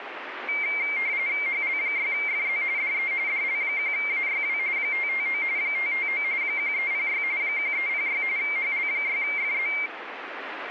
RTTY (45.45 baud, 170 Hz shift), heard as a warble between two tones, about 2200 Hz centre, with radio static. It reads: HL6FZ DE DL1AYW 559 559 1306 1306 HL6FZ